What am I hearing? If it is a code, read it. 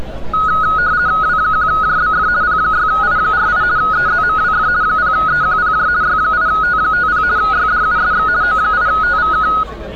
RTTY (50 baud, 170 Hz shift), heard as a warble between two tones, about 1360 Hz centre, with street noise. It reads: W1JBF P6I48 EZMWF 0EQPJ Y8T50 YDUSX O8TVK